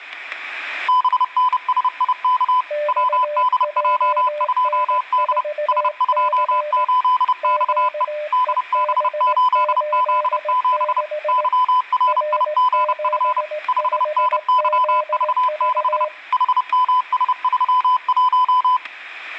Morse code, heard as two keyed tones, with static crashes. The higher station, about 30 wpm, 1000 Hz: BNSIK WDJ2D S28XE DB8Z7 YRIGF 5NYV6 HMS31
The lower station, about 18 wpm, 600 Hz: XJN4C QEB86 R75ZV